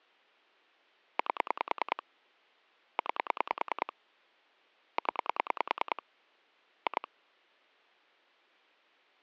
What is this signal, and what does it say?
Pulse dialling, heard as clicks on a phone line, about 10 pulses a second. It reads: 8 9 0 2